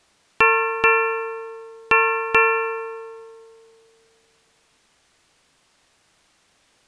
Ship's bell, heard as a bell. 4. Four half-hours of the watch have passed.